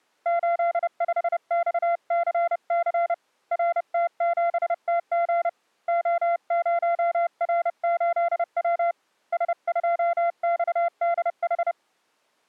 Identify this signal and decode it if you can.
Morse code, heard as a keyed tone, hand-sent with a bug key, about 30 wpm, 690 Hz. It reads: 85XCC RT7TG O0R8W S2XDH